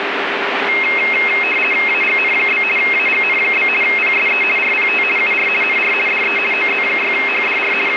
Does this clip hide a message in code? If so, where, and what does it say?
Yes: RTTY (50 baud, 450 Hz shift) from 0.7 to 8.0 s, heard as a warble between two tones, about 2350 Hz centre, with radio static. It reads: AGN? AGN? PSE RPT UR NR DE OZ6HDR …